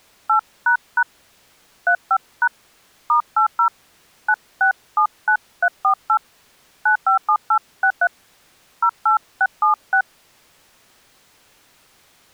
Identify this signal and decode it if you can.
DTMF, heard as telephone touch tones, dialled by hand, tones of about 90 ms. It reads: 8## 35# *80 9679348 957863 08676